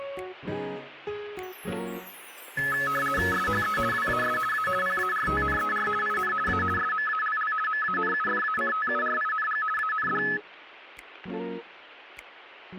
RTTY (50 baud, 450 Hz shift), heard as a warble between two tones, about 1500 Hz centre. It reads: SHE WAS A PARTNER IN A SMALL MANUFACTURING AND